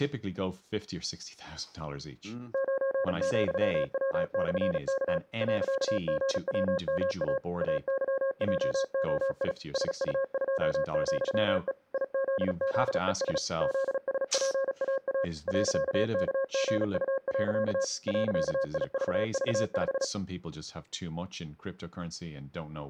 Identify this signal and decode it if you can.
Morse code, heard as a keyed tone, machine-sent, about 36 wpm, 540 Hz, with speech in English. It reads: 9,W/K .GWMA AYJOI SU2,E IZZES ZSPAA .KGU. .IVV5